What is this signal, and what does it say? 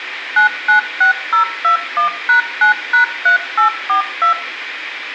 DTMF, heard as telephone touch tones, dialled by machine, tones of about 110 ms, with radio hiss, a squelch burst at the end and room echo. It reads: 996021#9#3842